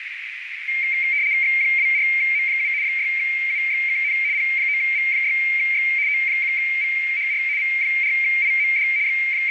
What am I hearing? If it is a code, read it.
RTTY (75 baud, 170 Hz shift), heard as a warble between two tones, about 2200 Hz centre, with radio static and a narrow filter. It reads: X24M7 6UXKN P9V6X O1VHR V4IMD …